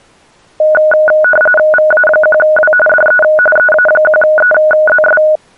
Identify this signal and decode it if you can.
RTTY (45.45 baud, 850 Hz shift), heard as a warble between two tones, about 1040 Hz centre. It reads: VA1W DE EA1EZS